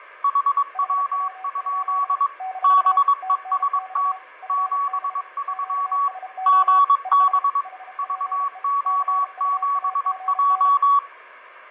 Morse code, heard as two keyed tones, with radio static and fading. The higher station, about 22 wpm, 1130 Hz: HW? BEST 73 GB VO7J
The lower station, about 32 wpm, 750 Hz: HW? - TNX FB QSO ES HPE CUAGN